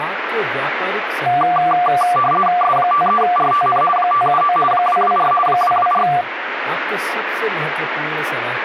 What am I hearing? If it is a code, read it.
RTTY (50 baud, 450 Hz shift), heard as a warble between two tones, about 940 Hz centre, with radio static and speech in Hindi. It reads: S53RTN 579 224 224